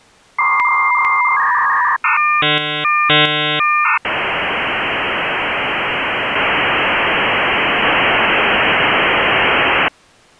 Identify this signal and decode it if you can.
Dial-up modem handshake (V.34 or later), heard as a whistle, warbles, then hiss.